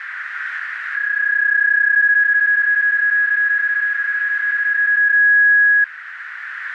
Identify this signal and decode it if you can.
PSK31 (31.25 baud), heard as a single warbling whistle, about 1650 Hz, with radio static and a narrow filter.